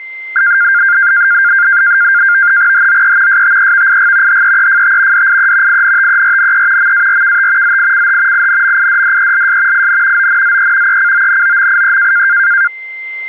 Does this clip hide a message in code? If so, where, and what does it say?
Yes: NAVTEX (SITOR-B), 100 baud, 170 Hz shift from 0.4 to 12.7 s, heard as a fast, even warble, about 1500 Hz centre, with a steady whistle near 2080 Hz. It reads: HOE STEVIG HEEFT DIE INTERNE MARKT ZICH INMIDDELS IN ONZE ECONOMIE